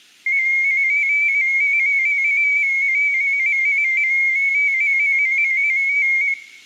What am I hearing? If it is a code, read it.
Multi-tone FSK (Olivia or MFSK type), about 250 Hz wide, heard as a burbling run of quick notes, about 15.625 baud, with room echo.